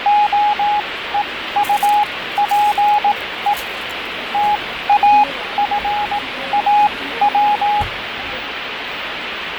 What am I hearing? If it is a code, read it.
Morse code, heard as a keyed tone, machine-sent, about 18 wpm, spaced as for 14 wpm, 830 Hz, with radio static, fading and the noise of a cafe. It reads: OEUPE TAFAW